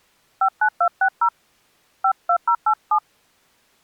DTMF, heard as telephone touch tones, dialled by hand, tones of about 80 ms. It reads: 59260 52087